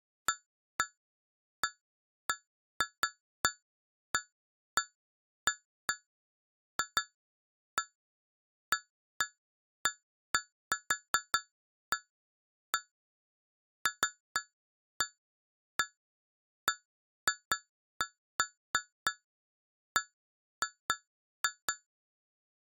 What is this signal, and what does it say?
Irregular taps on glass. There is no code.